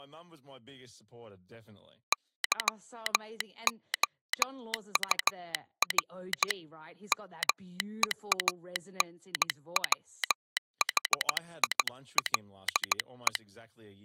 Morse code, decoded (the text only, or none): YOUR MEANWHILE